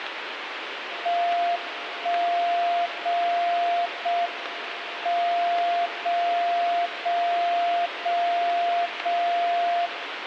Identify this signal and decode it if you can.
Radio time signal (JJY), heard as a tone whose level steps once a second, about 700 Hz, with radio static. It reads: 1 0 0 M 0 0 0 0 0